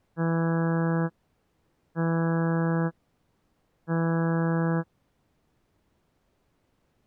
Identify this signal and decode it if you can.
Ship horn signal, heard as a ship's horn, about 170 Hz. 3 short. At sea: I am operating astern propulsion.